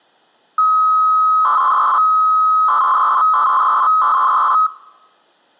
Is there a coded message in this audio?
Yes: 300-baud modem data (Bell 103 tones) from 0.6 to 4.7 s, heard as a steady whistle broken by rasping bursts, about 300 baud, 200 Hz shift.